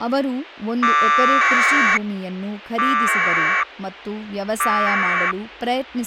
Packet radio (AX.25, as in APRS), 1200 baud, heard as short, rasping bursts, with speech in Kannada.